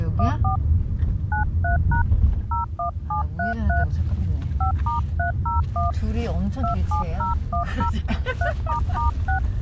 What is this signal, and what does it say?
DTMF, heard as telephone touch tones, dialled by hand, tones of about 120 ms, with the noise inside a car. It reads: 14 93# 01733 5*301 27010 3**6